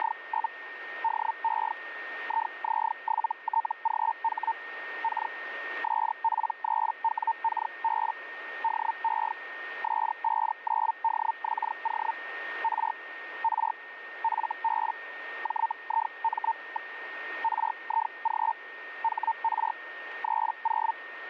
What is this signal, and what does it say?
Hellschreiber (Feld-Hell, 122.5 baud), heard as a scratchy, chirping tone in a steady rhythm, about 900 Hz, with radio static and a steady whistle near 1840 Hz. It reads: … DE IZ7TGH K SP3WKB DE S59DXO R R FB JIM. RIG HR 30